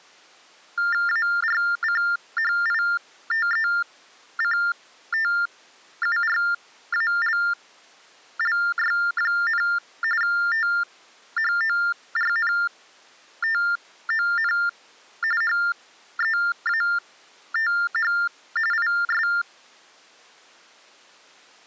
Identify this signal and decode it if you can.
TTY/TDD text telephone tones (45.45 baud Baudot), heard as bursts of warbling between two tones, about 400 Hz shift, 1600 Hz centre. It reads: ARCHITECTURALLY, THORNTON HEATH IS